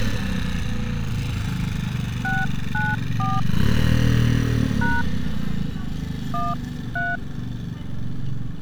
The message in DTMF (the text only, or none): 694 # 13